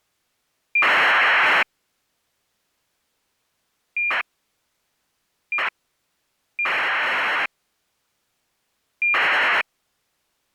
ACARS aircraft data, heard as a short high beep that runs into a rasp, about 2400 baud.